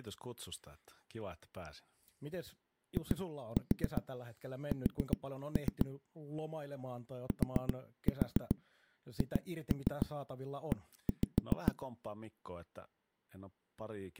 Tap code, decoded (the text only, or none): IS THE